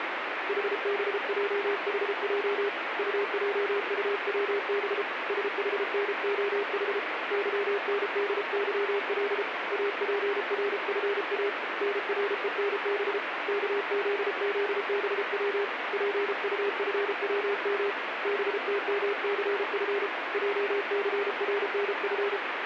Morse code, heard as a keyed tone, hand-sent with a paddle, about 33 wpm, 400 Hz, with radio static. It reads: HBJHJ UJUWB SHNOH YNDYL APRFA NRENB KZZBW PUFWM BTMCF JCRNF